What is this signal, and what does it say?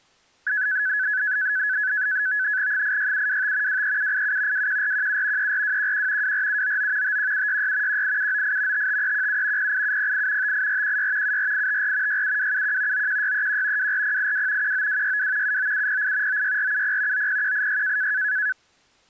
NAVTEX (SITOR-B), 100 baud, 170 Hz shift, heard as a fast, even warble, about 1600 Hz centre. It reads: 86725 23787 21417 34211 24799 51766 18798 55317 08708 58416 74854 67271 91631 24082 19262 79708 96470 90186